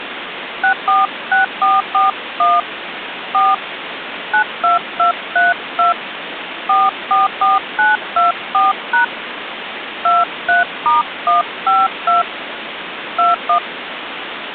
DTMF, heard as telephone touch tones, dialled by hand, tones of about 150 ms, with phone line noise. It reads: 646441 4 92232 444924# 23*152 21